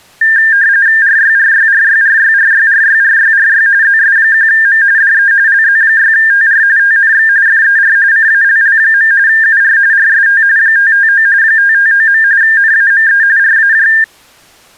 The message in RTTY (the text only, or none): RYRYRYRYRYRYRYRY ZS1M DE LZ6TR TNX FER CALL. UR RST 559 559. NAME RAJ